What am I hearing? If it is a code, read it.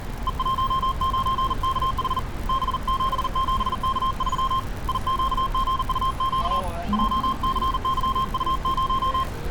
Morse code, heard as a keyed tone, hand-sent with a paddle, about 40 wpm, 1060 Hz, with street noise. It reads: E19KH B77K3 IQGUQ JCYU0